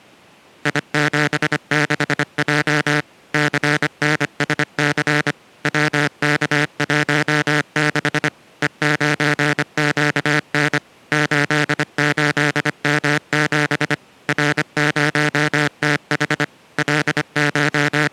Morse code, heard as a buzzer, machine-sent, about 25 wpm. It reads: I76J CNSC WK16 E9QN 88M7 R0TH …